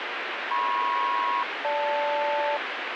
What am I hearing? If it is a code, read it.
Aircraft SELCAL, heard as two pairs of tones, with radio static. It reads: MP-GL